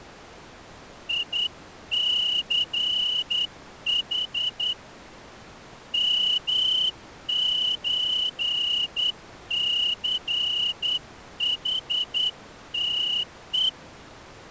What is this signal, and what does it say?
Morse code (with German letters), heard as a whistle, hand-sent with a straight key, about 10 wpm. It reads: ICH MÖCHTE